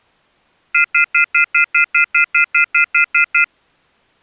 Telephone call progress tone (North American plan), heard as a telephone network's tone, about 1400, 2050, 2450, 2600 Hz, 0.1 s on and 0.1 s off. Off-hook warning tone.